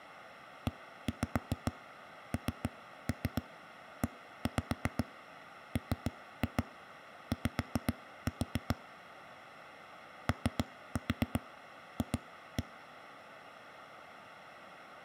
Tap code, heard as knocks on a wall, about 7 knocks a second. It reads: ENEMY OF